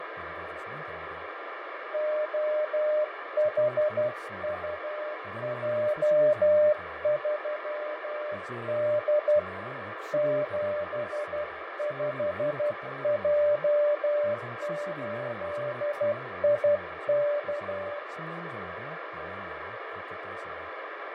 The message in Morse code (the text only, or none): OHUJ3D 75J8IK